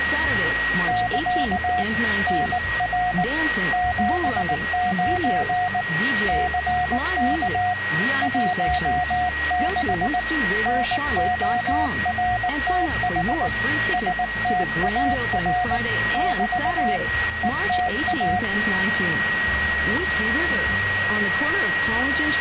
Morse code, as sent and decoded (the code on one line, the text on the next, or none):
-.-.- / -. .-. / --... ----. / -.-. -.- / .---- -.... / -. --- .-. - .... / ... - .- .-. / -...- / . - .-
<KA> NR 79 CK 16 NORTH STAR <BT> ETA